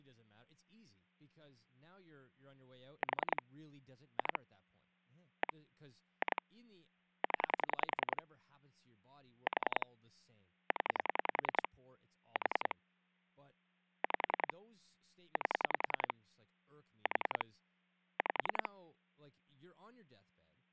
Pulse dialling, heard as clicks on a phone line, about 10 pulses a second, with hum and speech in English. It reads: 4 2 1 2 0 4 0 4 5 8 4 5